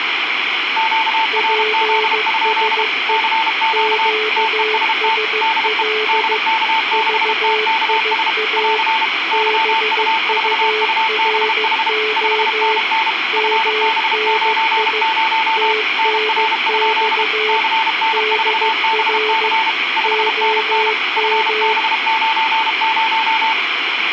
Morse code, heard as two keyed tones, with radio static. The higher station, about 32 wpm, 890 Hz: QRZ? CQ TEST DE DK6TKS <AR> YU4UBH 5NN FB90 NR? CN4BC 5NN FB90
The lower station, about 15 wpm, 430 Hz: PSE QSL VIA BURO MNI TNX DR OM